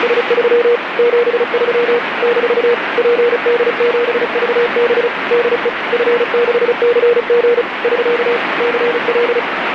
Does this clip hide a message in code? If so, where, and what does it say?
Yes: Morse code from 0.0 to 9.5 s, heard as a keyed tone, machine-sent, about 35 wpm, 480 Hz, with radio static. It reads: … 73 - PD7VB DE F6CG <SK> CL